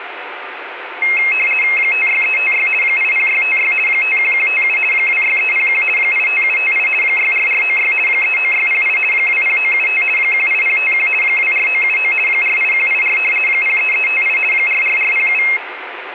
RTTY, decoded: 56356 80656 51157 26301 85758 64496 39608 20975 18051 24979 48184 03358 44407

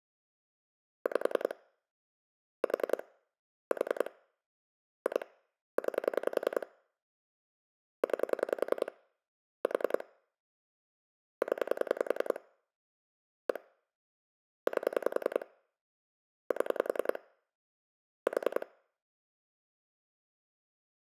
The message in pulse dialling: 5 4 4 2 9 9 4 0 1 8 7 4

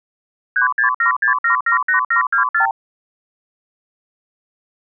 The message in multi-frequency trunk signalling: 3676778724

